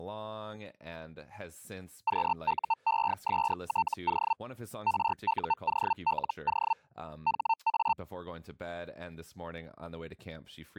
Hellschreiber (Feld-Hell, 122.5 baud), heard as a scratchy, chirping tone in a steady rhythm, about 900 Hz, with speech in English. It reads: QUESTO RUOLO HA